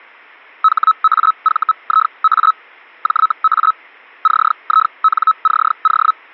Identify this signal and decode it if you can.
Hellschreiber (Feld-Hell, 122.5 baud), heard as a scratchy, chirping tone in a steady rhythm, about 1290 Hz. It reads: HAVIA JA CINCO